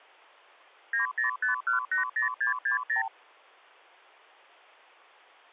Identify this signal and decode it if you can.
Multi-frequency trunk signalling (R2, with the far end's replies), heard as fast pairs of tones, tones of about 120 ms. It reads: 905180660